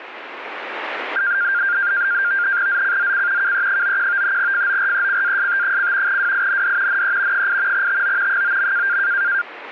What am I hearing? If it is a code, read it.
NAVTEX (SITOR-B), 100 baud, 170 Hz shift, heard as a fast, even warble, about 1500 Hz centre. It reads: ZCZC KE91 FORECAST: WIND NE 8 TO 9.